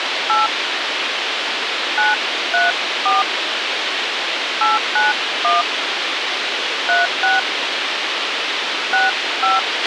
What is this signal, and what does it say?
DTMF, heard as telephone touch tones, dialled by hand, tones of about 170 ms, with radio hiss and a squelch burst at the end. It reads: 8 934 891 36 65